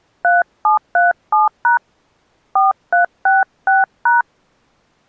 DTMF, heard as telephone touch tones, dialled by hand, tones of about 150 ms. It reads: 3737# 4366#